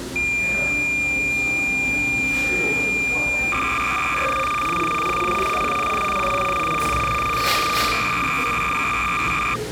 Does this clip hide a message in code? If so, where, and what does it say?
Yes: cassette data (Kansas City type), 300 baud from 0.2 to 9.6 s, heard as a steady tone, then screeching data, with the noise of a cafe.